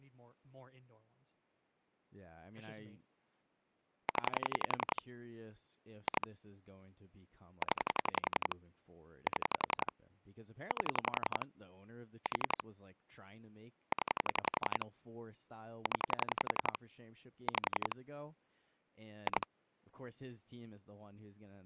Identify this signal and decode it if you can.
Pulse dialling, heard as clicks on a phone line, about 11 pulses a second, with speech in English. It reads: 0 2 0 7 8 4 0 0 5 2